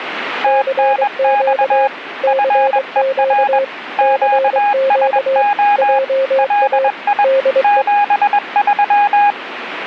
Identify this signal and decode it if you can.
Morse code, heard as two keyed tones, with radio static. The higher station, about 21 wpm, 820 Hz: TNX FER QSO LI 73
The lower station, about 23 wpm, 540 Hz: CQ CQ CQ JA DE